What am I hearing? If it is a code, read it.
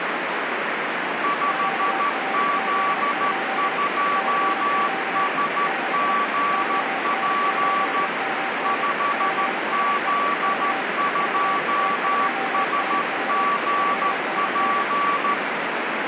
Morse code, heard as two keyed tones, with radio static. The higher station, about 13 wpm, 1150 Hz: 5Z2SGP 5Z2SGP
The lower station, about 31 wpm, 780 Hz: QRZ? CQ DE ON8MN PSE K VA2SV 5NN